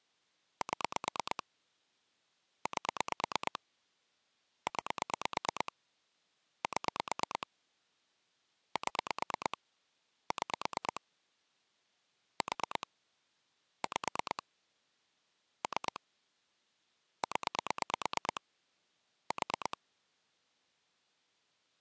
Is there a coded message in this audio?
Yes: pulse dialling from 0.6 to 19.7 s, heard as clicks on a phone line, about 9 pulses a second. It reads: 7 8 9 7 7 6 4 5 3 0 4